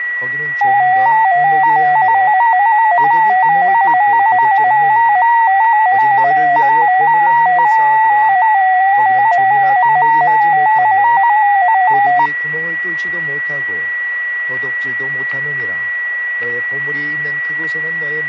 Multi-tone FSK (Olivia or MFSK type), about 250 Hz wide, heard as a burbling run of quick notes, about 15.625 baud, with a steady whistle near 1940 Hz and speech in Korean.